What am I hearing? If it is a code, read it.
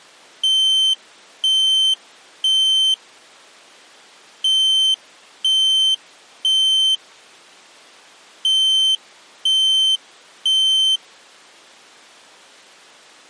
Alarm pattern, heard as an alarm's beeps, played three times, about 3100 Hz. Temporal three. Smoke or fire, evacuate.